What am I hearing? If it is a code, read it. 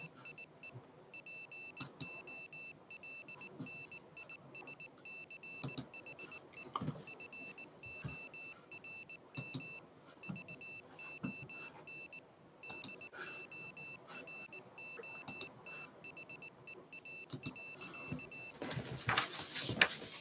Morse code, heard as a high beeper, machine-sent, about 19 wpm, 2650 Hz. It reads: … POLNISCHE FORM VON DOROTHEA.